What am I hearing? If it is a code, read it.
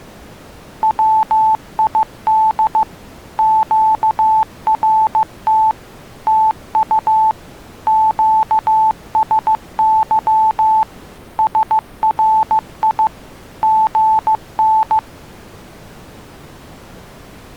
Morse code, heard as a keyed tone, machine-sent, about 15 wpm, 880 Hz. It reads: WID QRT TU QSY SRI GN